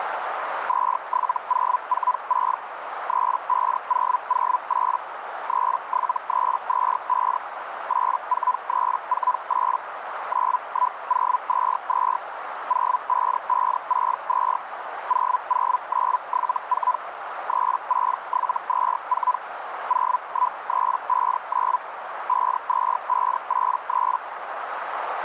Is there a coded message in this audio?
Yes: Hellschreiber (Feld-Hell, 122.5 baud) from 0.7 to 24.2 s, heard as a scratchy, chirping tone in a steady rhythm, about 1000 Hz, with radio static and a narrow filter. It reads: 27046 35008 37325 84348 91022 05562 00974 36724 01359 52583